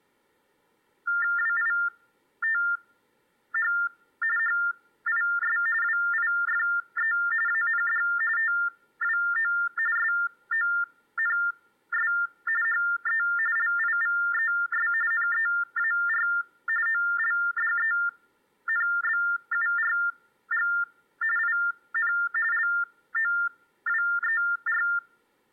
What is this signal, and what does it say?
TTY/TDD text telephone tones (45.45 baud Baudot), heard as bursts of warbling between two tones, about 400 Hz shift, 1600 Hz centre. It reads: WITH HIS WIFE AND TWO SONS HE LIVES NEAR OLDENBURG IN LOWER